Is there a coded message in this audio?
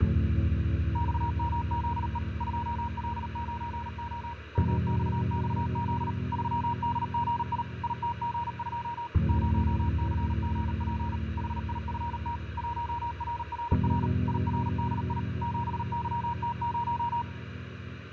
Yes: Morse code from 0.9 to 17.3 s, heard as a keyed tone, machine-sent, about 38 wpm, 950 Hz, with radio static and fading. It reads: XMZE 2L9O MXXZ 3DGI ITG2 0CGP HIFT 1RRR IRDI 7YT0